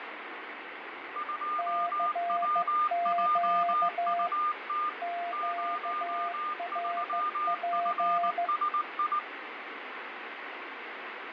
Morse code, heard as two keyed tones, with radio static and fading. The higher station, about 19 wpm, 1210 Hz: 2WJUT 03FSI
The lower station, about 15 wpm, 690 Hz: CQ QRP